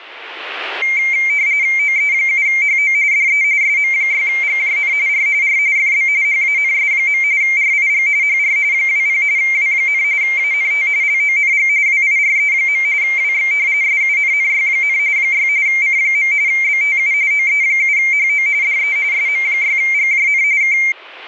RTTY (45.45 baud, 170 Hz shift), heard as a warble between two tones, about 2200 Hz centre, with radio static. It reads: OE7HO DE SM6GJN R R FB HANS. RIG HR 20 W, ANT LONG WIRE. WX SUNNY, 6 C. BTU OE7HO DE SM6GJN K